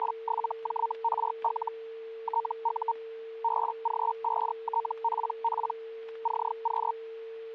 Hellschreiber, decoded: … TU BG5TPP CQ

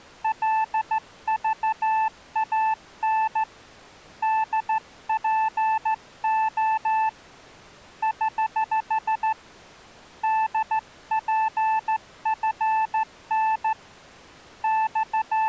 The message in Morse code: LVAN DPO <HH> DPFN …

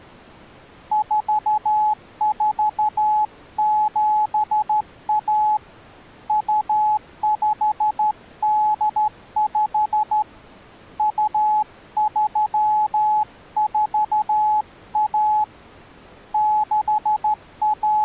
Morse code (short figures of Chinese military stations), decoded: 4471 2585 2341 …

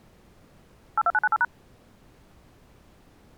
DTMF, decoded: 82998#

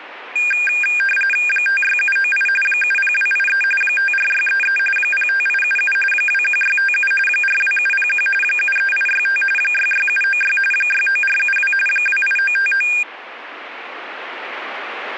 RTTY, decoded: 56798 70283 54633 05877 21657 42701 73865 66796 69472 28959

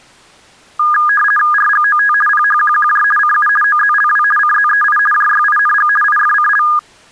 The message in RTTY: RGOT PHQQJ CU OZLW CZEI JYING IFCL

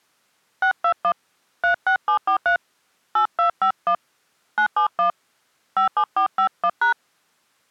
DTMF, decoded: 621 36743 8251 971 57451#

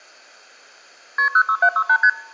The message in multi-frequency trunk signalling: KP 06768 ST

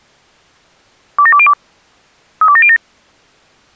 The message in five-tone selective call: 27202 32707

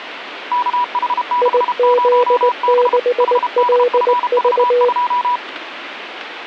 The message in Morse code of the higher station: KH60B HDFV2

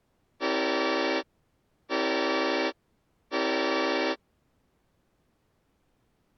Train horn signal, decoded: 3 short

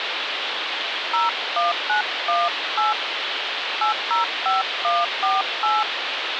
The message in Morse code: none

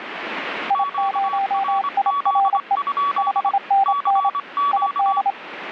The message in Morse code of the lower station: I0IRE 5NN ID

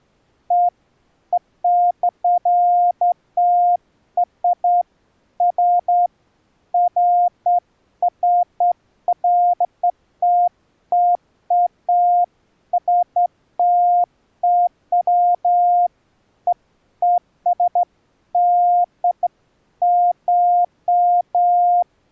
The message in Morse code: none

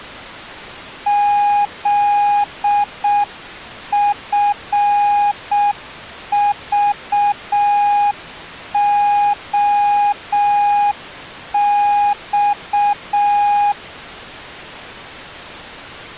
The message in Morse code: ZFVOX

